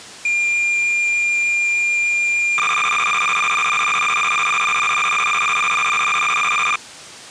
Cassette data (Kansas City type), 300 baud, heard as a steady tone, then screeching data.